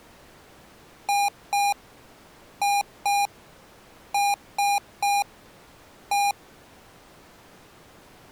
Beep code, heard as beeps from a small speaker, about 810 Hz. 2-2-3-1. In Phoenix BIOS tables: unexpected interrupt.